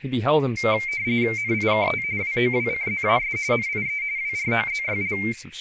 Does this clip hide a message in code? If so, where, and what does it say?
Yes: RTTY (45.45 baud, 170 Hz shift) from 0.6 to 5.3 s, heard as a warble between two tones, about 2200 Hz centre, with radio static and speech in English. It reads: NIKT WOWCZAS NIE WROZYL